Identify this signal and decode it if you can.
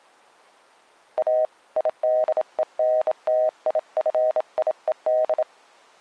Morse code, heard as a keyed tone, hand-sent with a bug key, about 27 wpm, 630 Hz. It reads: A IDENTIFIED